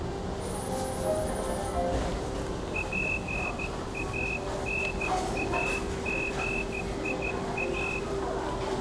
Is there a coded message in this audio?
Yes: Morse code (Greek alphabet) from 2.7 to 8.0 s, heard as a whistle, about 13 wpm, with room echo and the noise of a restaurant. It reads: ΠΑΝΑΓΙΑ